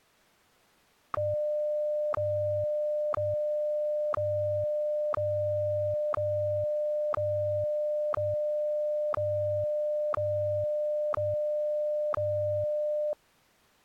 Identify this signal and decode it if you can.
Radio time signal (WWVH, Hawaii), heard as ticks, one a second.